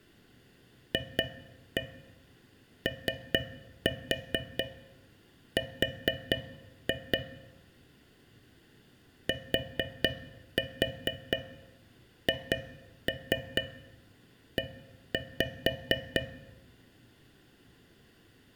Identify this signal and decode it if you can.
Tap code, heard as taps on a metal pipe, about 4 knocks a second, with room echo. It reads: FOR THE